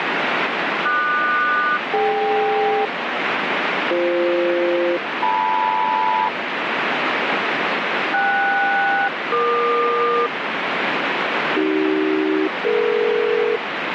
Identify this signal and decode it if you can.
Aircraft SELCAL, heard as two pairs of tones, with radio static. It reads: QS-DK BF-LM KS-EQ AC-DE